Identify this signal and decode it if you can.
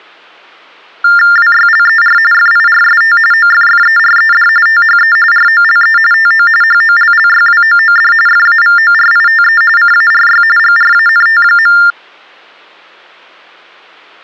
TTY/TDD text telephone tones (45.45 baud Baudot), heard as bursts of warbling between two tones, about 400 Hz shift, 1600 Hz centre. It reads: WYLER FIRST OFFERED THE ROLE TO HOLLYWOOD FAVORITE CARY GRANT.